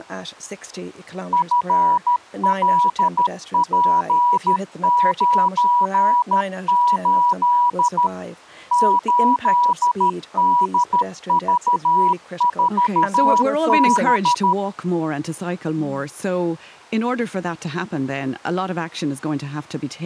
Morse code, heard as a keyed tone, machine-sent, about 13 wpm, 970 Hz, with speech in English. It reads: FLP98 8DV4B